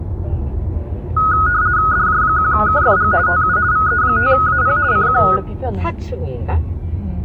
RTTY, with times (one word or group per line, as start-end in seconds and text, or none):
1.9-3.1 DJ1KFG
3.3-3.6 TU
3.7-4.8 VE5AP
4.9-5.2 CQ